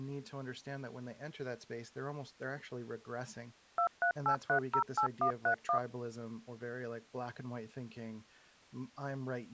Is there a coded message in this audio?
Yes: DTMF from 3.8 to 5.8 s, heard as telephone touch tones, dialled by machine, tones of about 90 ms, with speech in English. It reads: 238308131